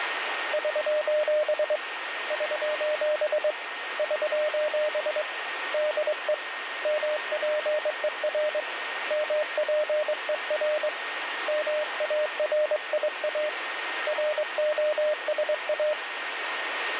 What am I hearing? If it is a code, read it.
Morse code, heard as a keyed tone, hand-sent with a straight key, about 22 wpm, 610 Hz, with radio static and a steady whistle near 1850 Hz. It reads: <SOS> <SOS> <SOS> DE MPER MPER MARIA ROSA